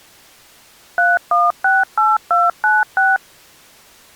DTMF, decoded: 3168296

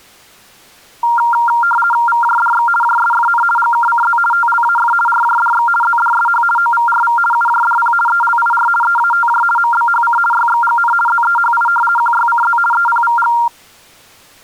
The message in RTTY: VJDX JSFN GKCZ TLAF RJDX ZDSH OVRV UJDP ELIR EATJ MBHC YXGN ZEHI QYCZ EPVG

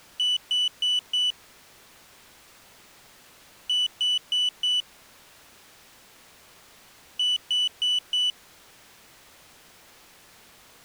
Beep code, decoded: 4 short

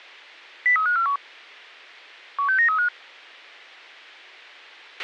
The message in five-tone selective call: 03541 16935

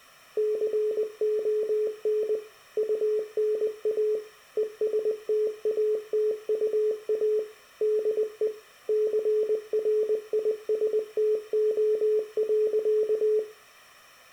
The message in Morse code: CON UNA ESTATUA DE CRISTO.

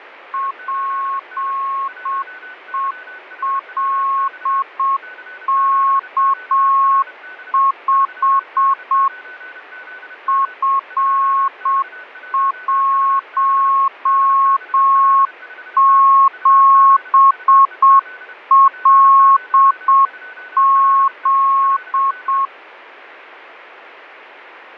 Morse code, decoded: PELK5 F17LZ

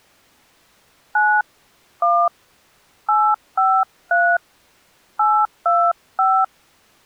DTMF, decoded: 9 1 853 825

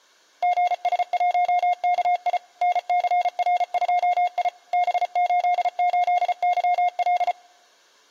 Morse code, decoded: GS1KI NCR2I B88YL

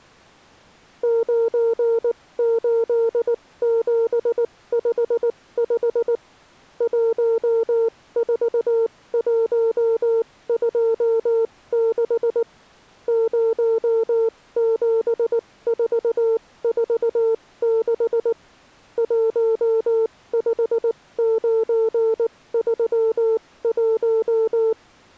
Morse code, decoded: 98755 14126 07446 15931

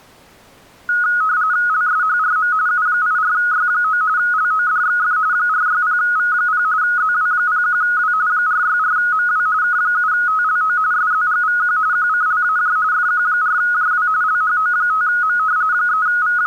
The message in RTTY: LSHRM U84Y9 LODXF 460V0 ZW01W 464MW K7TLO SZGVQ QCLAJ FQ4JW LHO5M …

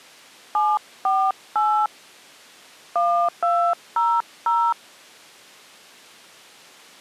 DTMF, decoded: 748 1200

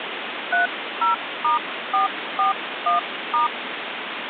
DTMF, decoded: 30*441*

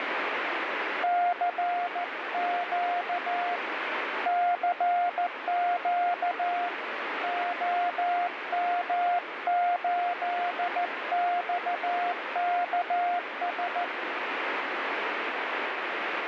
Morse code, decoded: CQ CQ OM8XKS

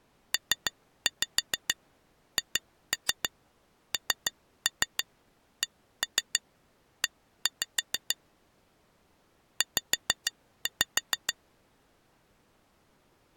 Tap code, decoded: PHNCE Z

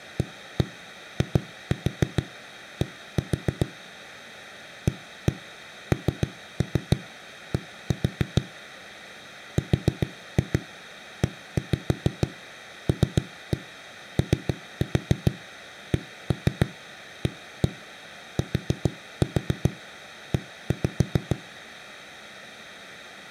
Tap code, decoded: AID AND RELOCATE

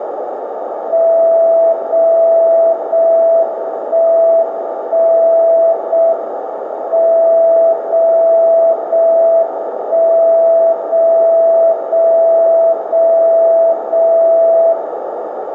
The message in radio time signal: 0 0 1 1 0 M 0 0 1 0 0 0 0 0

